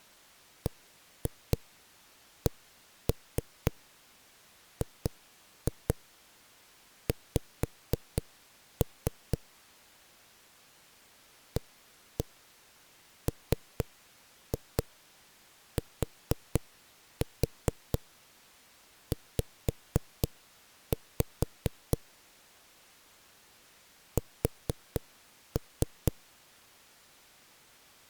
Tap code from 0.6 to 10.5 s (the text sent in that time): BCGX